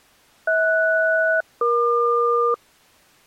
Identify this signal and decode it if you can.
Aircraft SELCAL, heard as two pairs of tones. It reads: HS-EQ